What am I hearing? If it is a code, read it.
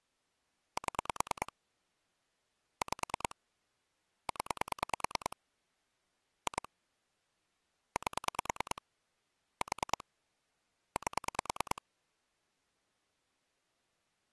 Pulse dialling, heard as clicks on a phone line, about 9 pulses a second. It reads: 7 5 0 2 8 4 8